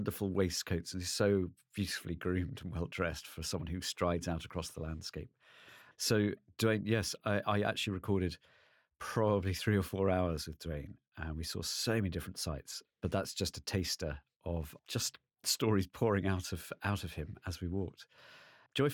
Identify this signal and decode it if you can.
Speech in English. There is no code.